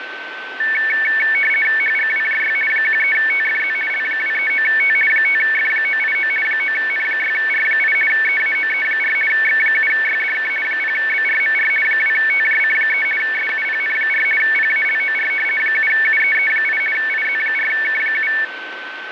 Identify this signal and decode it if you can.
RTTY (50 baud, 450 Hz shift), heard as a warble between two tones, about 2000 Hz centre, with radio static and a steady whistle near 1530 Hz. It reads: HGWJY 13TFZ L239T 5F989 9N6R8 EAOE4 X7YDK 0BRMR 2TJC3 SUPN4 PALOR 7UEE8 IZ4K7